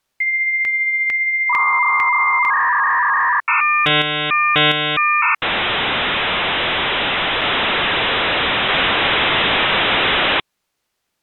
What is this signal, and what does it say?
Dial-up modem handshake (V.34 or later), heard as a whistle, warbles, then hiss.